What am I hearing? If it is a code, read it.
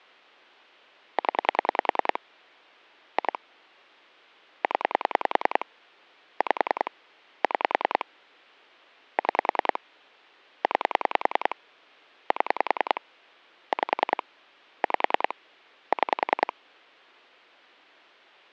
Pulse dialling, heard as clicks on a phone line, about 10 pulses a second. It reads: 0 2 0 5 6 6 9 7 5 5 6